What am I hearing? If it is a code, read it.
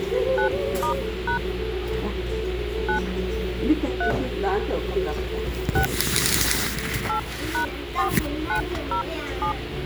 DTMF, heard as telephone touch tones, dialled by hand, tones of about 100 ms, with phone line noise and the noise of a restaurant. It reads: 9*# 9 3 6 8#4907